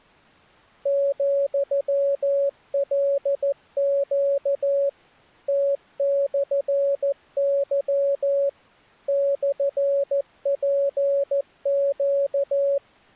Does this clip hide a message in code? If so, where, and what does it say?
Yes: Morse code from 0.8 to 12.8 s, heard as a keyed tone, machine-sent, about 14 wpm, 560 Hz. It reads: ,LQ T/Y /PQ